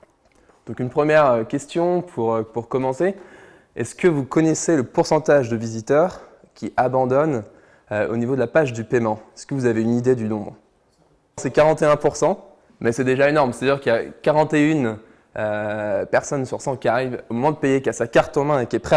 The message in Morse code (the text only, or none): none